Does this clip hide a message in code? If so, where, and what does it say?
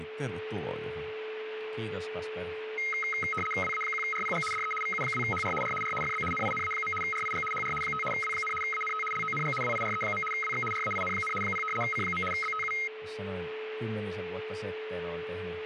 Yes: RTTY (75 baud, 850 Hz shift) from 2.8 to 12.9 s, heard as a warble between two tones, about 1700 Hz centre, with radio static, a steady whistle near 430 Hz and speech in Finnish. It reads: WA1RPG DE VU2HR R R FB NINA. RIG HR 5 W, ANT LONG WIRE. WX RAIN, 0 C. BTU